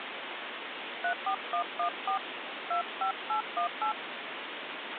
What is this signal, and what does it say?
DTMF, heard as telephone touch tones, dialled by hand, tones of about 90 ms, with phone line noise. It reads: 34114 25818